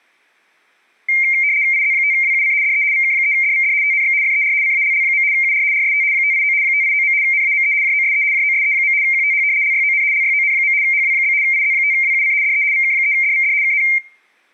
RTTY (75 baud, 170 Hz shift), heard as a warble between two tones, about 2200 Hz centre, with room echo. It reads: IZ5WUC DE VK3DVD TNX FER CALL. UR RST 589 589. NAME JOSE JOSE. QTH LYON LYON. HW? IZ5WUC DE VK3DVD KN